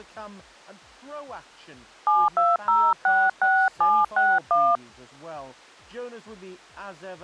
DTMF, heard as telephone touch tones, dialled by hand, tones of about 210 ms. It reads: 72066761